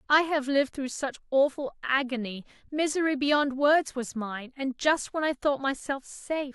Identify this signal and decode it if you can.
Speech in English. There is no code.